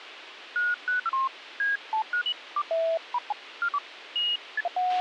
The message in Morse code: none

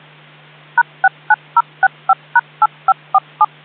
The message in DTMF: #69065#8547

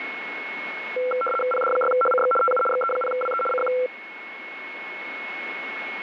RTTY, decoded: PD6HCX TU XE0WE CQ

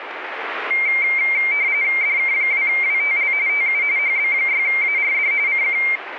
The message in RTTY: DK2WTL TU HB6ARD CQ

